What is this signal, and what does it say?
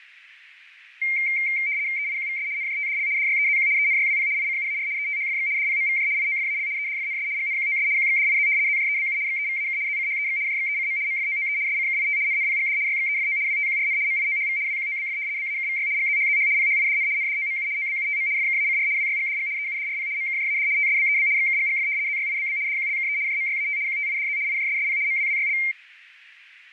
RTTY (75 baud, 170 Hz shift), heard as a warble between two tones, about 2200 Hz centre, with radio static. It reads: EIQVS NJTDL DYEZQ ENYWP ICUAR ETHFX DPMVJ IOFAL EDFNS GNQOS QXDIZ ZJEBU XEVAK ZCHEX JXECM MFOOE SCKIT NNPGD YXEFO WTQRN MIOHV WQOBF BAKVY GZHZH PHIDN NDOMU OBUTM FKACR WYGDG EUDRP MKJAD TSBEB XKGGF ZYIBB DQLKE JMYAT QTIDZ IJSSP MWWYL